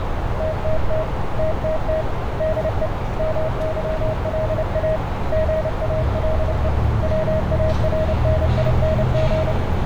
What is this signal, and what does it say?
Morse code, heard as a keyed tone, hand-sent with a paddle, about 29 wpm, 630 Hz, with heavy radio static, a narrow filter and street noise. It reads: TTT TTT DE MYLA GALE WARNING